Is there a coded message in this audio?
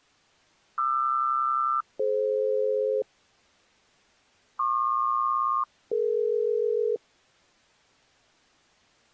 Yes: aircraft SELCAL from 0.8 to 7.0 s, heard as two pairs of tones. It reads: QR-DF PQ-DE